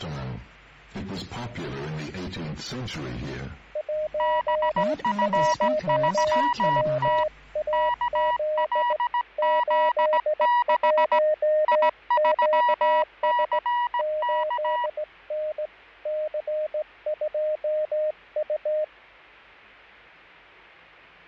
Morse code, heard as two keyed tones, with fading. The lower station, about 17 wpm, 610 Hz: 11WAZ 81QS 8N C2U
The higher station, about 17 wpm, 970 Hz: BF3T KLZ6 I3CK